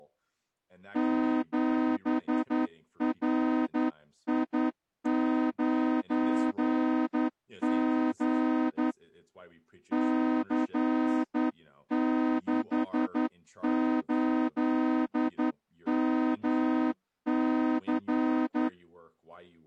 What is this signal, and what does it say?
Morse code, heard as a horn, hand-sent with a straight key, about 11 wpm, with speech in English. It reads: 7RI9G C68MC